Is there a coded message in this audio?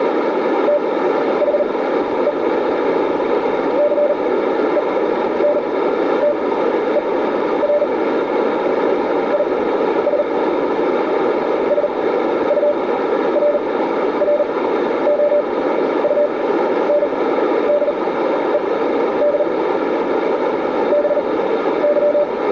Yes: Morse code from 0.6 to 22.3 s, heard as a keyed tone, machine-sent, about 39 wpm, spaced as for 12 wpm, 590 Hz, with radio static and a narrow filter. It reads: THE CENTER IS SURROUNDED BY